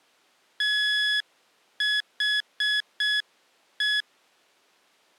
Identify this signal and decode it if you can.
Morse code, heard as electronic beeps, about 6 wpm, 1700 Hz. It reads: THE